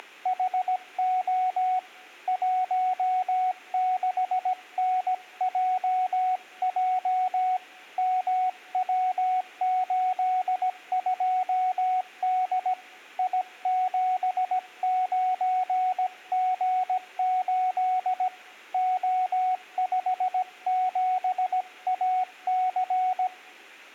Morse code, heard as a keyed tone, hand-sent with a paddle, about 17 wpm, 740 Hz. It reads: … 16NJJ MW82D I79G8 O57AC